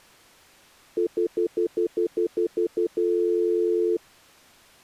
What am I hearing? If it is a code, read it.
Telephone call progress tone (North American plan), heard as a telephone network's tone, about 350, 440 Hz, 0.1 s on and 0.1 s off. Stutter dial tone.